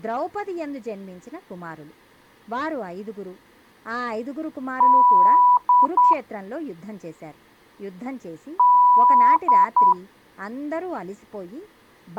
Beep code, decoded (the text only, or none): 1 long, 2 short